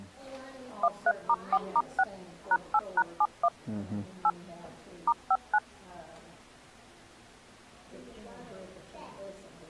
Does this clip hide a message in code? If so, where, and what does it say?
Yes: DTMF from 0.8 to 5.6 s, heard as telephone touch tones, dialled by machine, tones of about 50 ms. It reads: 13*4*6 #8#71 8 *59